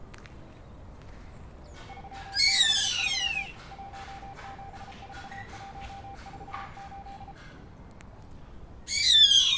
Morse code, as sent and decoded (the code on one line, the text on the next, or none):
...-- -.... ...-- / .---- --... ....- .---- ....- ---..
363 174148